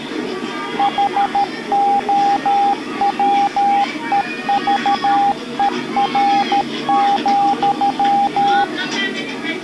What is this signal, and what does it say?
Morse code, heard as a keyed tone, machine-sent, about 13 wpm, 800 Hz, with the noise of a park. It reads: HOWEVER,